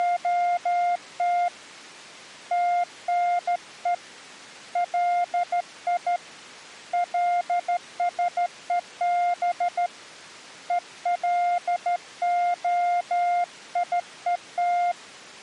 Morse code (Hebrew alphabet), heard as a keyed tone, hand-sent with a straight key, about 13 wpm, 700 Hz. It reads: … תנו לי לשוב ולהיות